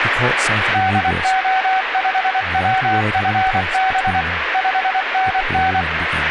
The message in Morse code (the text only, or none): DO5WFB 5NN